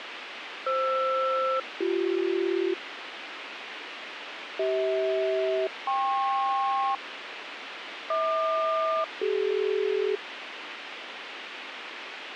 Aircraft SELCAL, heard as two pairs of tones, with radio hiss. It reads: FR-BC CH-KP HQ-CD